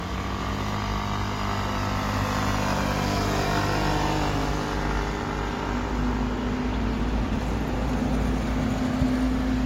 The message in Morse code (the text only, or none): none